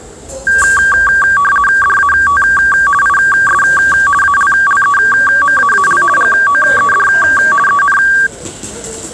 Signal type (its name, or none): RTTY